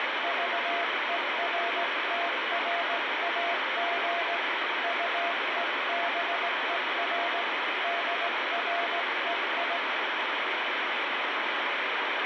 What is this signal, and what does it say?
Morse code, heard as a keyed tone, hand-sent with a straight key, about 17 wpm, 690 Hz, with heavy radio static. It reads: VERTRAG UEBER DREI